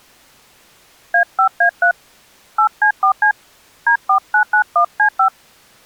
DTMF, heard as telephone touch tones, dialled by hand, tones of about 90 ms. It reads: A5A3 8C4C D4991C5